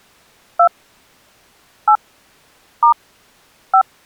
DTMF, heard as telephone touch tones, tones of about 90 ms. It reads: 2 8 * 5